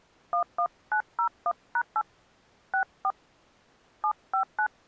DTMF, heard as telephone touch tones, dialled by hand, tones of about 80 ms. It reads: 11901#8 64 759